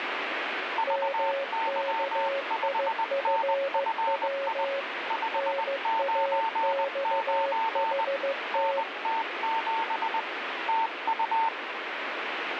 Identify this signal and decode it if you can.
Morse code, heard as two keyed tones, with radio static. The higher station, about 20 wpm, 900 Hz: VY5NFI 599 NT7 TU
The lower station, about 15 wpm, 550 Hz: MKIFW NAXHT